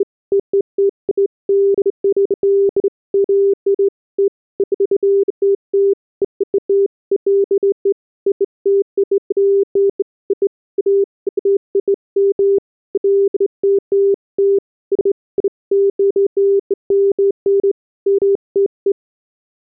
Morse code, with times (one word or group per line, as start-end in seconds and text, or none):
none